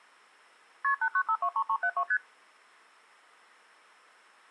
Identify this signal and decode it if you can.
Multi-frequency trunk signalling (R1, as on North American trunks), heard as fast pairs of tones, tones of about 70 ms. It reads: KP 89523372 ST